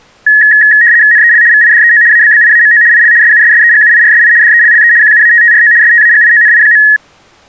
RTTY (75 baud, 170 Hz shift), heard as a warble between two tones, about 1800 Hz centre. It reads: NEL VIDEO ABBIAMO IL SUSSEGUIRSI DELLE QUATTRO STAGIONI.